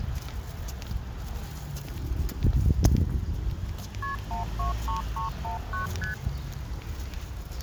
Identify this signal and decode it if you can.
Multi-frequency trunk signalling (R1, as on North American trunks), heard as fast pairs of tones, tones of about 130 ms, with the noise of a residential street. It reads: KP 123319 ST